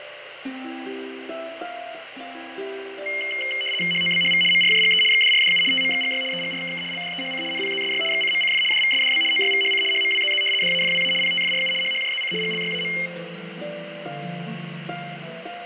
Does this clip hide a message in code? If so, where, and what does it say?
Yes: RTTY (75 baud, 850 Hz shift) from 3.1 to 13.1 s, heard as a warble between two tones, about 2550 Hz centre, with radio static and fading. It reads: HOBHV MRJGE XDRDU TMXGY EGRKK LDEHC NPZSY XCMCF DVSDB OYVHC HMWZZ DAFWA PTFRU HHJZC GLYAM